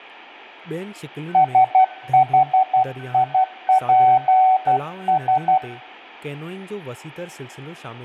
Morse code, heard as a keyed tone, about 12 wpm, 750 Hz, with a weaker station near 1520 Hz, room echo and speech in Sindhi. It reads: SHIPS